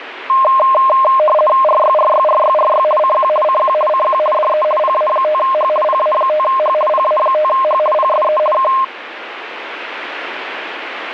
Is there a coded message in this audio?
Yes: RTTY (50 baud, 450 Hz shift) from 0.3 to 8.8 s, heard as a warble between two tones, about 840 Hz centre, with radio static. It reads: RYRYRYRY CQ CQ CQ DE PA5H PA5H PA5H PSE K